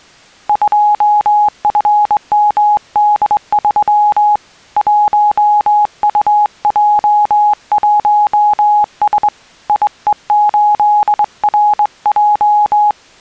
Morse code, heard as a keyed tone, hand-sent with a straight key, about 22 wpm, 840 Hz. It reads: 2FMD3 1UJ1S IE8RJ